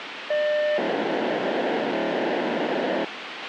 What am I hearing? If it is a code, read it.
POCSAG pager data (1200 baud), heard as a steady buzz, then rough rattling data, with radio hiss and a squelch burst at the end.